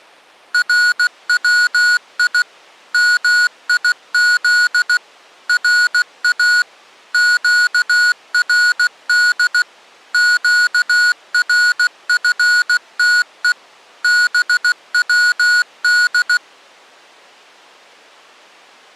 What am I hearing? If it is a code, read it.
Morse code (Persian alphabet), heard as electronic beeps, machine-sent, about 16 wpm, 1460 Hz. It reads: روی میز را گرد گرفته بود